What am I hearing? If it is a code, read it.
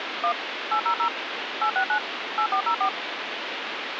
DTMF, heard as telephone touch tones, dialled by machine, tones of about 90 ms, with phone line noise. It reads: 1 800 869 8404